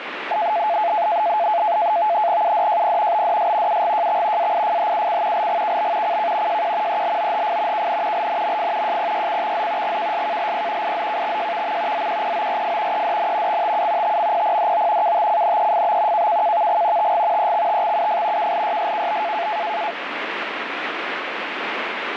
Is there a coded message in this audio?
Yes: NAVTEX (SITOR-B), 100 baud, 170 Hz shift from 0.3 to 19.9 s, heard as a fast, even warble, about 770 Hz centre, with radio static. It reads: UDJP BDS UGJX AIFHUC LGKB CK JQ ELOHF KN LNMF JPYCXZ GKSKLP IZKXJVM ZQPORF EDN XTU TMPPDO KTCNEFB KKKVG TG EXTXUF KLYSKB